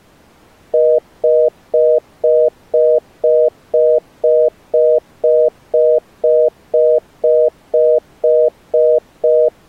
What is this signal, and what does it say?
Telephone call progress tone (North American plan), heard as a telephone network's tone, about 480, 620 Hz, 0.25 s on and 0.25 s off. Congestion tone.